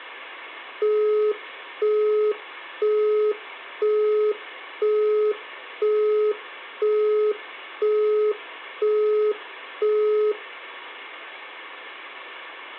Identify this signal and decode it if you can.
Telephone call progress tone (single-tone plan, as in Europe, Japan and elsewhere), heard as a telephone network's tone, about 420 Hz, 0.5 s on and 0.5 s off, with hum. Busy tone.